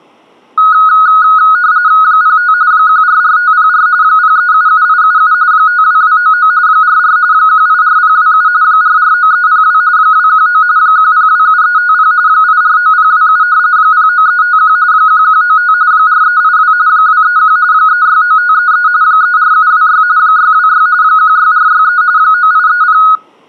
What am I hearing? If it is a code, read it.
RTTY (45.45 baud, 170 Hz shift), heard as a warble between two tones, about 1360 Hz centre. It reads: 05 144504 0377877 52299 44 184027 449302 219 1027350 849027 09351 1195 4382 231 369533 34726 626 16463 9830